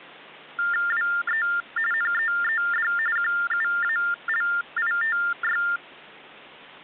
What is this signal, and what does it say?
TTY/TDD text telephone tones (45.45 baud Baudot), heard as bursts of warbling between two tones, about 400 Hz shift, 1600 Hz centre. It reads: WE NEED QUALITY